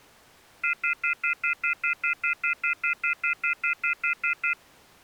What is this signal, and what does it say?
Telephone call progress tone (North American plan), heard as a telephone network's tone, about 1400, 2050, 2450, 2600 Hz, 0.1 s on and 0.1 s off. Off-hook warning tone.